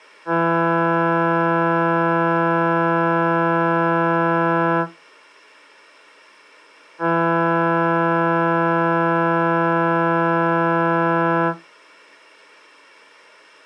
Ship horn signal, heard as a ship's horn, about 170 Hz. 2 long. At sea: a vessel under power that has stopped in fog.